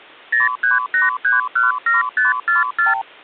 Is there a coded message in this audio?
Yes: multi-frequency trunk signalling (R2, with the far end's replies) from 0.3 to 3.0 s, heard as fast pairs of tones, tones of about 150 ms. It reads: 038317544